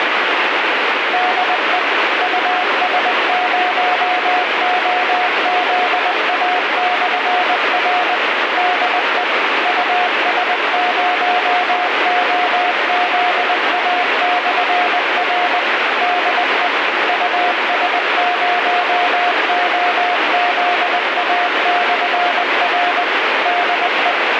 Morse code, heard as a keyed tone, machine-sent, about 20 wpm, 720 Hz, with heavy radio static. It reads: DE US0OZA/R DE US0OZA/R DE US0OZA/R DE